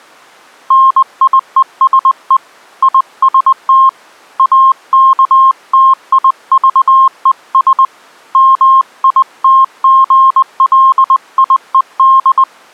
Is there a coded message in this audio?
Yes: Morse code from 0.6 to 12.5 s, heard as a keyed tone, hand-sent with a paddle, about 20 wpm, 1060 Hz. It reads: NIESE IST AKTIVES MITGLIED